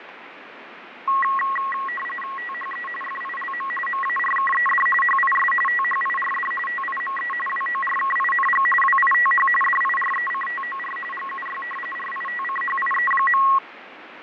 RTTY (45.45 baud, 850 Hz shift), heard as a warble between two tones, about 1500 Hz centre, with radio static and fading. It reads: THE FILM MARKED HIS THIRD TIME WORKING WITH DIRECTOR GUY RITCHIE.